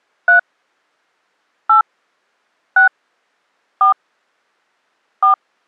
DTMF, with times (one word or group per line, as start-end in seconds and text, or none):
0.3-0.4 3
1.7-1.8 8
2.8-2.9 6
3.8-3.9 4
5.2-5.3 4